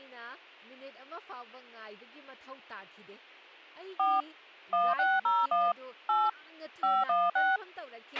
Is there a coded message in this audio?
Yes: DTMF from 4.0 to 7.6 s, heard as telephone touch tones, dialled by machine, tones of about 210 ms, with a squelch burst at the end and speech in Manipuri. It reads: 4 1601 8 516